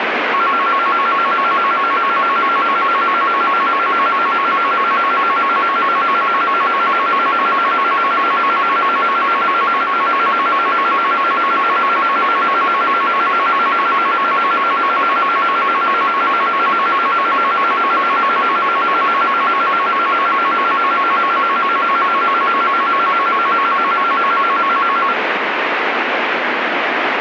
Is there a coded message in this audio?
No, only a tone that alternates evenly between two pitches, with radio static.